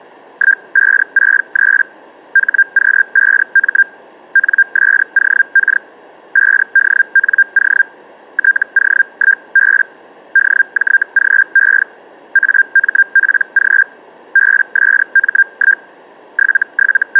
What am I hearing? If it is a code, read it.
Hellschreiber (Feld-Hell, 122.5 baud), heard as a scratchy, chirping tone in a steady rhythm, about 1600 Hz. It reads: 1563 HQ5M NSOK 5DNO TO1B DJGE AMPG BSM1 …